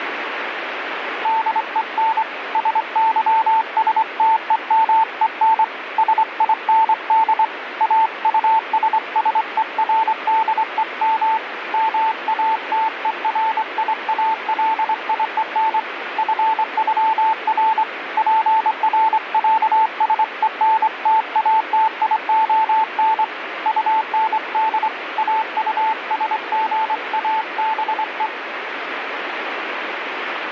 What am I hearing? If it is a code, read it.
Morse code (with German letters), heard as a keyed tone, hand-sent with a straight key, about 24 wpm, 880 Hz, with radio static. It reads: DEN SYSTEMEN SIND AUSSERDEM MATERIALIEN FÜR PRÄSENTATION UND AUSGABE